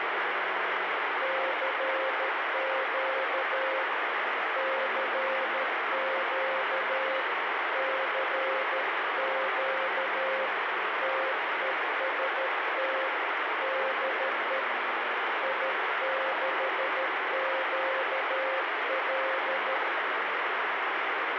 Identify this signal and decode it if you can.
Morse code, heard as a keyed tone, hand-sent with a paddle, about 13 wpm, 530 Hz, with heavy radio static. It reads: CQ CQ CQ TEST DE I6QL